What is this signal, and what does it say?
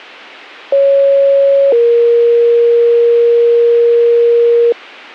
Two-tone page, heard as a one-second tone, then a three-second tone, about 550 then 470 Hz.